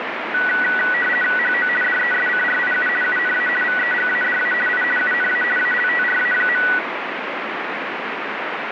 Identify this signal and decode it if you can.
RTTY (50 baud, 450 Hz shift), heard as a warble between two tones, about 1700 Hz centre, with radio static. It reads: HO DESCRIU UNA VEGADA I UNA ALTRA.